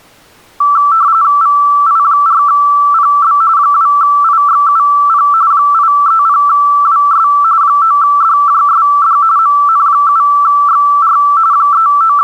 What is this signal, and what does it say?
RTTY (45.45 baud, 170 Hz shift), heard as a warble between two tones, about 1240 Hz centre. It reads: VI4PB 2IXUP 830WS 9DJSD MN7XR …